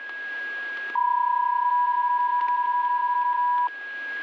PSK31 (31.25 baud), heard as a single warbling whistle, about 980 Hz, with static crashes and a steady whistle near 1650 Hz.